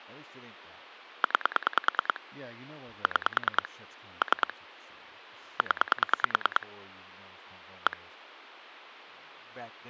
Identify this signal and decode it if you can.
Pulse dialling, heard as clicks on a phone line, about 9 pulses a second, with speech in English. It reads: 9 6 3 0 1